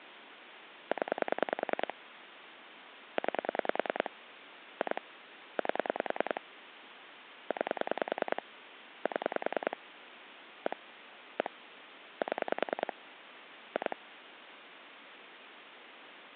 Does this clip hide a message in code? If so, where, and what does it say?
Yes: pulse dialling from 0.9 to 13.9 s, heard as clicks on a phone line, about 10 pulses a second, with phone line noise. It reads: 0 9 2 8 9 7 1 1 7 2